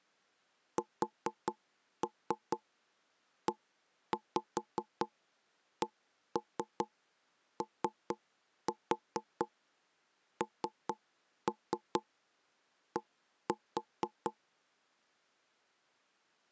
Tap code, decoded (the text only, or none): SECOND